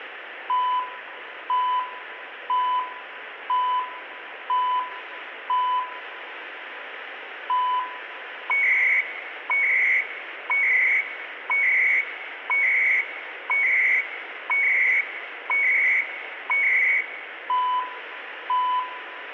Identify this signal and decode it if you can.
Radio time signal (CHU, Canada), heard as beeps and data bursts, one a second, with radio static and room echo.